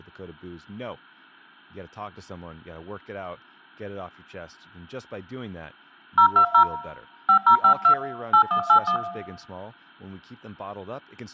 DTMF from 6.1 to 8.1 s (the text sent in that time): 020 5052